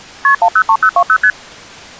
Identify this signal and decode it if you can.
Multi-frequency trunk signalling (R1, as on North American trunks), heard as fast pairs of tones, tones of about 70 ms. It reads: KP 103020 ST